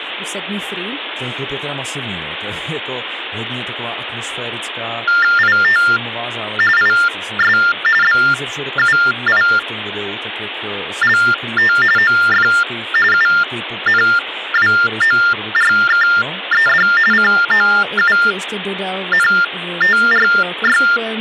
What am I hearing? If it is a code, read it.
TTY/TDD text telephone tones (45.45 baud Baudot), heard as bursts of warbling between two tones, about 400 Hz shift, 1600 Hz centre, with phone line noise and speech in Czech. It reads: IT IS BUILT OF UNWORKED COUNTRY